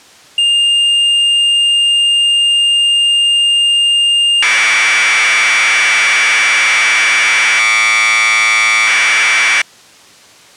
Commodore tape loading (standard loader), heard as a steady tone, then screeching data.